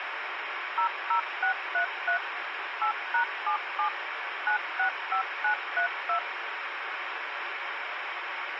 DTMF, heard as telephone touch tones, dialled by machine, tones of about 100 ms, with radio hiss. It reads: 00633 8#77 965932